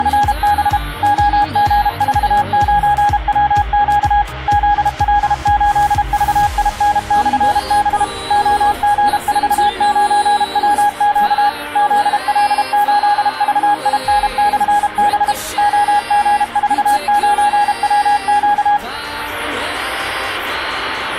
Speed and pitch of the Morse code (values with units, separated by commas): 32 wpm, 820 Hz